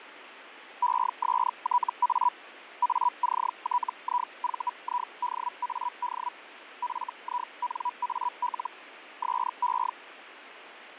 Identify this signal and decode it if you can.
Hellschreiber (Feld-Hell, 122.5 baud), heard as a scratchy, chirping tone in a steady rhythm, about 980 Hz, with radio static and fading. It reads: ESTA ACTIVIDAD FINAL SE